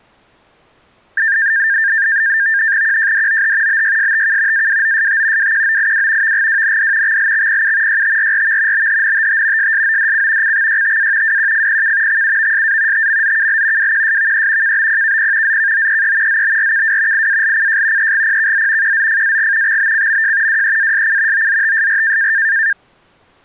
NAVTEX (SITOR-B), 100 baud, 170 Hz shift, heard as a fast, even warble, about 1700 Hz centre. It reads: QJDOH BYSTK AWOST WQOIW VGWND XLXPU YTRRV BHNTT SSODC CXYTA WQFPK XUVSA TMZKL WQSVE KBPKP ZKOEE ZBRKW IALCJ EGPKZ QZFAG XBCMJ WEASC OZTSR